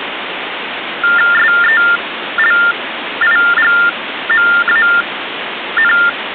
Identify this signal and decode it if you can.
TTY/TDD text telephone tones (45.45 baud Baudot), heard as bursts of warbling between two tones, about 400 Hz shift, 1600 Hz centre, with phone line noise. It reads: SELIGMAN